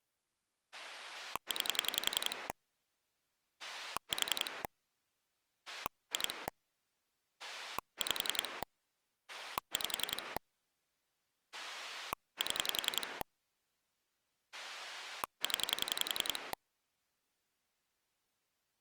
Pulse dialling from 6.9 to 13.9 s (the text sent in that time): 5 5 7